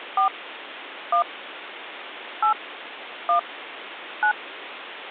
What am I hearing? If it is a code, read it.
DTMF, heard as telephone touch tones, dialled by hand, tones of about 100 ms, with phone line noise. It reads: 4 1 8 1 9